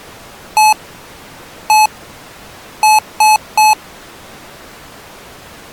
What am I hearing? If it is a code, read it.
Beep code, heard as beeps from a small speaker, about 860 Hz. 1-1-3. In Phoenix BIOS tables: CMOS read or write failure.